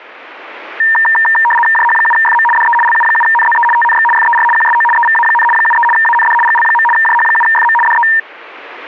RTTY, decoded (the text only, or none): JH7FM DE LU7NZE TNX FER QSO EVA, 73 AND GL. JH7FM DE